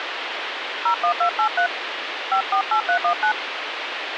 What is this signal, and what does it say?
DTMF, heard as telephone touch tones, dialled by hand, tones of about 90 ms, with phone line noise. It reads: 01283 548319